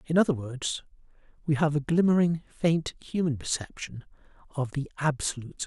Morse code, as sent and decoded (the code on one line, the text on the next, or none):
none